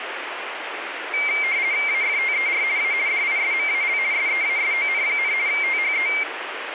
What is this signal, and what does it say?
RTTY (50 baud, 170 Hz shift), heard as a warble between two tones, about 2200 Hz centre, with radio static. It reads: AFTER A DISMAL SEASON, THE